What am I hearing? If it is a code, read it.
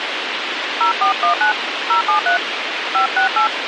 DTMF, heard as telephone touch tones, dialled by hand, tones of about 110 ms, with radio hiss. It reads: 0419 073 568